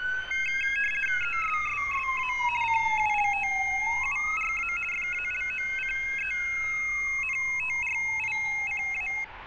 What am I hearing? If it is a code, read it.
RTTY (50 baud, 450 Hz shift), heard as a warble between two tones, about 2350 Hz centre, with street noise. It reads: ESSSA CULTURA FALOCENTRICA